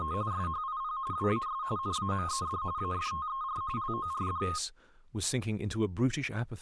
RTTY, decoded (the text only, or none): … SHIP WAS NAMED AFTER LORD